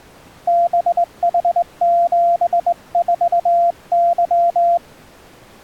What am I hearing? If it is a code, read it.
Morse code, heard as a keyed tone, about 20 wpm, 690 Hz. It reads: BH74Y